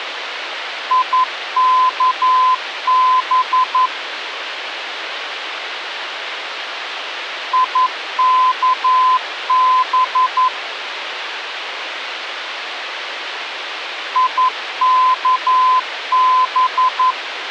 Morse code, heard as a keyed tone, machine-sent, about 11 wpm, 1020 Hz, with radio hiss. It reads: IKB IKB IKB